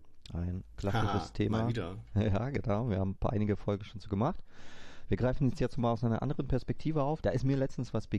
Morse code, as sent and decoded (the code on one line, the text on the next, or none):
none